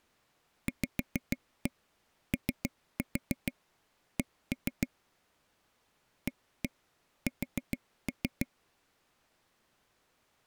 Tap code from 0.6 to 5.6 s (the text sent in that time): VOC